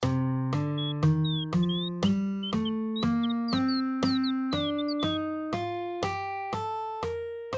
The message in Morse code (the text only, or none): none